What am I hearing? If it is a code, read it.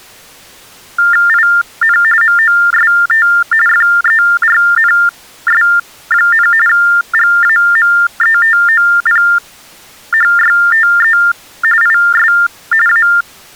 TTY/TDD text telephone tones (45.45 baud Baudot), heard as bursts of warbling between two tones, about 400 Hz shift, 1600 Hz centre. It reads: IN MOST FERNS, GAMETOPHYTE IS A